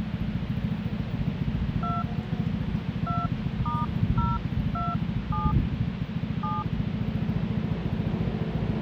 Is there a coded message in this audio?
Yes: DTMF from 1.8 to 6.6 s, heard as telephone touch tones, dialled by hand, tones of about 200 ms, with radio hiss and street noise. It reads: 2 2*027 7